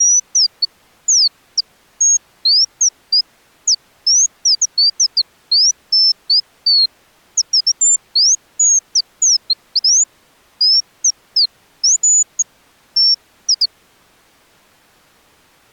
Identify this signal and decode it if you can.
Bird-like chirps. There is no code.